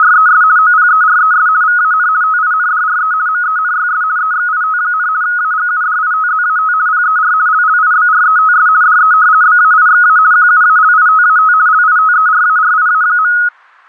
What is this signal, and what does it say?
RTTY (50 baud, 170 Hz shift), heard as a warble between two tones, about 1360 Hz centre. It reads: … OPERES VAN TINDRE MENYS EXIT, AGUDITZAT PER LLIBRETS DE BAIXA QUALITAT LITERARIA.